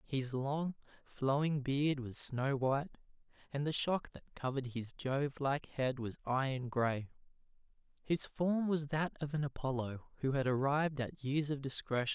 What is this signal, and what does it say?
Speech in English. There is no code.